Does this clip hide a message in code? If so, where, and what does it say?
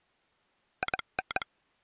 Yes: Morse code (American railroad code) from 0.8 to 1.5 s, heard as a telegraph sounder. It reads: IN